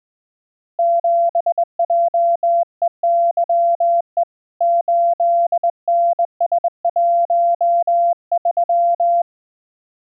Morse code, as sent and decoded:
--... .--- . -.-- . / ---.. -. ... .---- ...--
7JEYE 8NS13

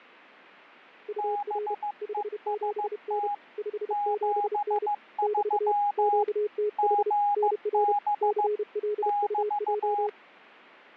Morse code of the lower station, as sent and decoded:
..- .-. / ..... --... -. / ..... --... -. / -...- / --.- - .... / -. .-. / -.-. .-.. ..- .---
UR 57N 57N <BT> QTH NR CLUJ

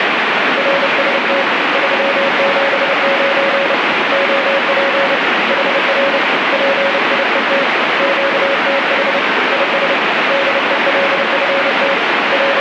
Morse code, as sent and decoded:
.-. ... - / ...-- --... ----. / --- .--. / .... .-. / .--. .. . - / --.- - .... / .. ... / -.. . .-.. ..-. - / …
RST 379 OP HR PIET QTH IS DELFT …

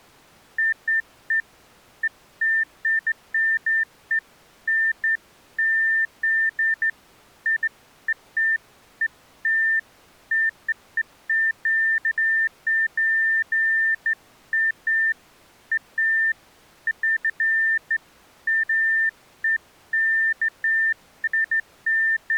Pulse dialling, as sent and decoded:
none

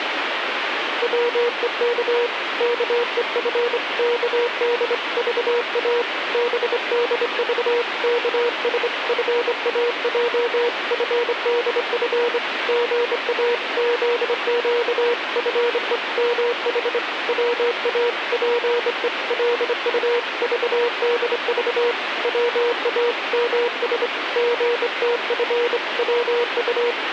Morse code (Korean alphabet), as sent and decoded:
.-- . -.- / -.- . ..-. -.- -.. ...- .- / -... -.. ...- -.- ... ..-. .- .--- ..-. -.. ..-. / --. .- --.. --.- ..-. . -- .... / .-- .- .--. . .-.. ..- ...- -.. ...- / .-- .- -- ... / --. - ..-. .-- ..-
방 안으로 들여놓는 소태나무 보자기를 보며 선비

